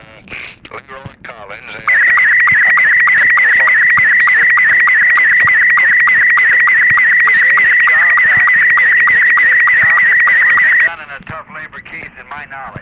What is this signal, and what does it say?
SSTV (slow-scan television), Robot 72, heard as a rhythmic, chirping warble.